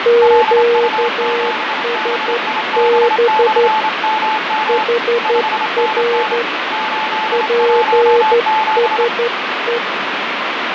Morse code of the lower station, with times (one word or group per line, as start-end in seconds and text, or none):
0.1-3.7 QSB
4.7-6.4 HR
7.3-9.8 PSE